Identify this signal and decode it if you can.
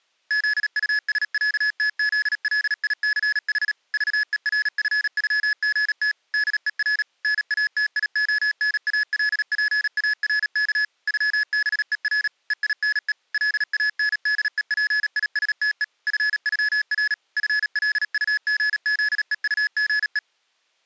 Morse code (with German letters), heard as electronic beeps, machine-sent, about 37 wpm, 1700 Hz. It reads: ZUSÄTZLICH VERFÜGT DER NATIONALPARK ÜBER EINE LANDEPISTE FÜR FLUGZEUGE